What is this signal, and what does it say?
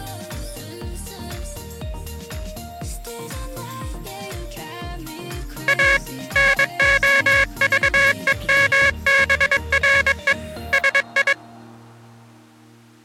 Morse code, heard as a buzzer, hand-sent with a paddle, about 22 wpm. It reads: A NOVEMBRE SI